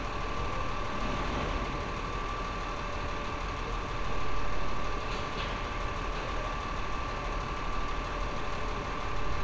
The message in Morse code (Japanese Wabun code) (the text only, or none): none